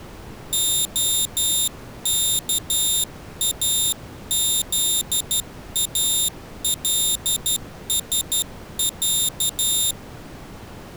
Morse code (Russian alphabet), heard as a high beeper, hand-sent with a straight key, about 12 wpm, 3650 Hz. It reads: ОКАЗАЛСЯ